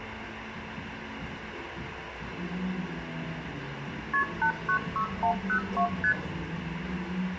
Multi-frequency trunk signalling (R1, as on North American trunks), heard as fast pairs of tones, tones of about 90 ms, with phone line noise, room echo and the noise of a cafe. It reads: KP 896102 ST